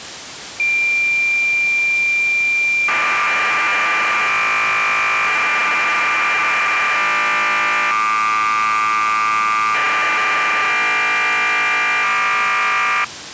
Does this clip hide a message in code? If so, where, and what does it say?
Yes: cassette data (Kansas City type), 1200 baud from 0.6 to 13.0 s, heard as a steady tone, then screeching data.